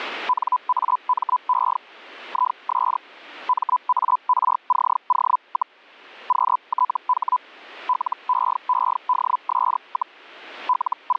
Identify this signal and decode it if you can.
Hellschreiber (Feld-Hell, 122.5 baud), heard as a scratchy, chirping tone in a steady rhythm, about 1000 Hz. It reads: NAME IS MARCO, QTH LEEDS, …